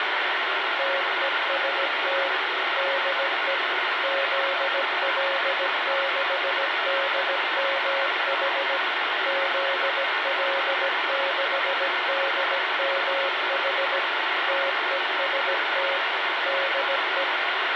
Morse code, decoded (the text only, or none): TEST DE ZL6DMH ZL6DMH TEST DE